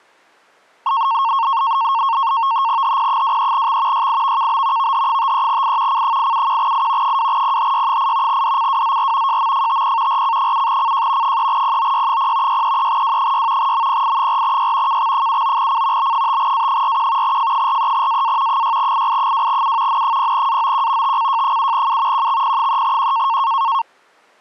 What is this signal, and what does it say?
NAVTEX (SITOR-B), 100 baud, 170 Hz shift, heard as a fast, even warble, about 1000 Hz centre. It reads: HP23X YIVKB VH53I C871I 2PHY8 DCWZR JMFTP RC7CJ 3POY0 633W6 MPI4Y KX79C B5A41 F43AA 6II2U N0AOQ TCJ7U QXP3Q